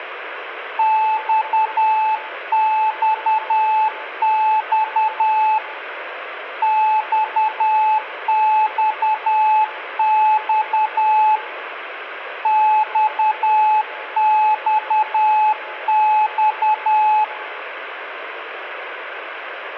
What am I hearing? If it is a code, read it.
Morse code, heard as a keyed tone, hand-sent with a paddle, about 10 wpm, 860 Hz, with room echo. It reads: XXX XXX XXX